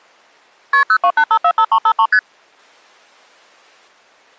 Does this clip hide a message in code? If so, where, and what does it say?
Yes: multi-frequency trunk signalling (R1, as on North American trunks) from 0.7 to 2.2 s, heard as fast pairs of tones, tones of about 70 ms. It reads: KP 028545353 ST